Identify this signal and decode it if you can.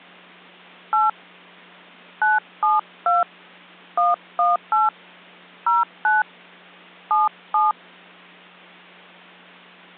DTMF, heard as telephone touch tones, dialled by hand, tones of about 170 ms. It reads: 8 972 118 09 77